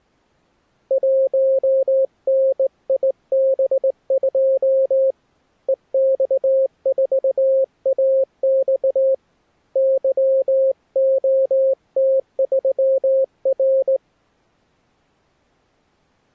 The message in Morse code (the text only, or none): 1NIB2 EX4AX YOT3R